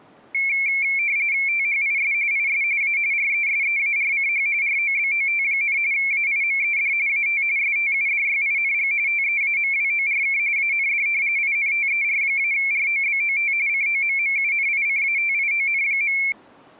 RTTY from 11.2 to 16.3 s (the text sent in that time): INTER-ROBOT COMMUNICATION.